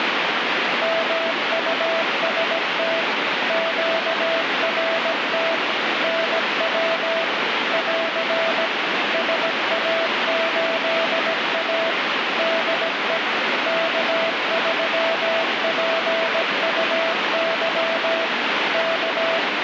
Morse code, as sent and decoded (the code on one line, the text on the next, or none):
-- ..- ... - / --.- .-. - / -. .-- / .-.-. / ... .- ---.. .- / -.. . / -.- ...-- .--. ..- -.-- / -.-
MUST QRT NW <AR> SA8A DE K3PUY K